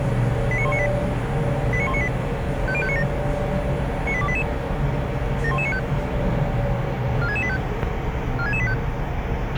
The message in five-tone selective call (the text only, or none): 89198 89198 50597 98288 71195 46685 46685